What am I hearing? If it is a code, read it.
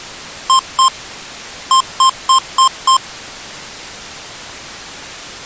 Beep code, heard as beeps from a small speaker, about 1050 Hz. 2-5.